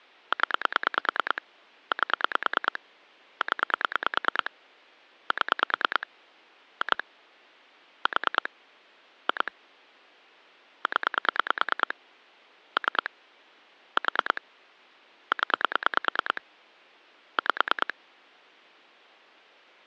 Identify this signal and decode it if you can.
Pulse dialling, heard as clicks on a phone line, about 9 pulses a second. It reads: 0 8 0 7 2 4 2 0 3 4 0 5